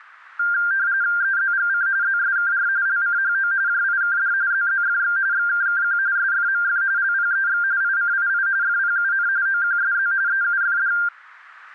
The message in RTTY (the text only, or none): EZGC ZSKR LCHO JIKD ZZFX XKKQ SFMF LPEX ICII FPUN OQSZ EUFD